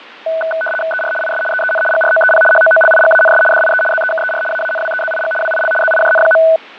RTTY (75 baud, 850 Hz shift), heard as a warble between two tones, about 1070 Hz centre, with fading. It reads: ER IS EEN GROEP HOOLIGANS DIE ZEKER AANWEZIG WIL ZIJN.